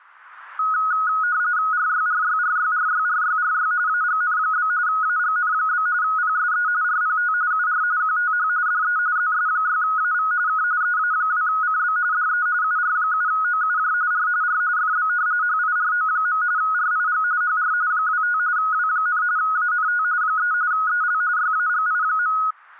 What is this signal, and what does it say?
RTTY (45.45 baud, 170 Hz shift), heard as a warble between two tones, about 1360 Hz centre. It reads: RYRYRYRYRYRY AGN? AGN? PSE RPT UR QTH DE ZS6AV K EA2CB DE UR7OUJ R R FB HIRO. RIG HR 25 W, ANT 3 EL YAGI.